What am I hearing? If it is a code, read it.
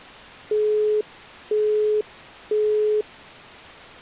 Telephone call progress tone (single-tone plan, as in Europe, Japan and elsewhere), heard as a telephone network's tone, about 420 Hz, 0.5 s on and 0.5 s off. Busy tone.